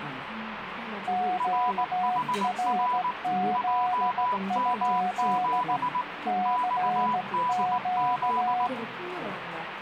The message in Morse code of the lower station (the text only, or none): QRZ? CQ